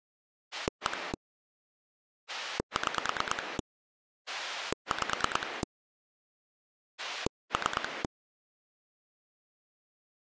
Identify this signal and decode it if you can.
Pulse dialling, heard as a rotary dial, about 9 pulses a second. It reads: 1 6 5 3